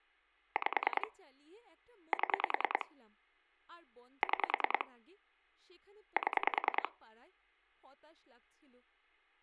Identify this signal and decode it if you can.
Pulse dialling, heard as clicks on a phone line, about 10 pulses a second, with speech in Bangla. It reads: 5 7 6 7